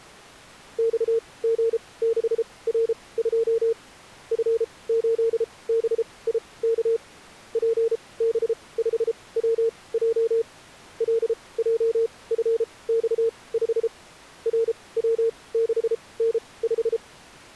Morse code, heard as a keyed tone, machine-sent, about 33 wpm, spaced as for 22 wpm, 460 Hz. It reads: XG6R2 F8BIK PB5WJ LJFX5 RW6N5